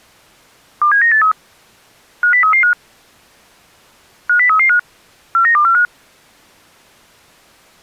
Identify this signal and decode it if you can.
Five-tone selective call (CCIR), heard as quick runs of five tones, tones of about 100 ms. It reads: 27983 50335 50335 49245